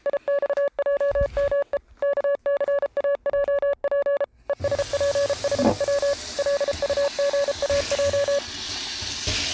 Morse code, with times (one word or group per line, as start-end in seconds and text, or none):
0.1-1.8 IXJME
2.0-4.2 KCAJP
4.5-6.1 ESPHW
6.4-8.4 LUGAJ